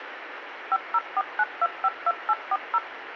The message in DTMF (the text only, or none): 5049252840